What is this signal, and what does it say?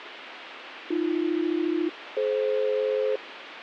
Aircraft SELCAL, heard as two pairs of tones, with radio hiss. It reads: AB-DF